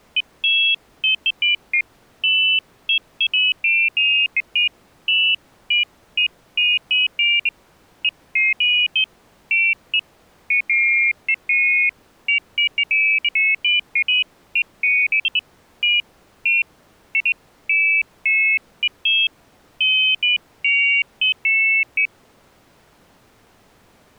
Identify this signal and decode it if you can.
Pairs of high tones at irregular times. There is no code.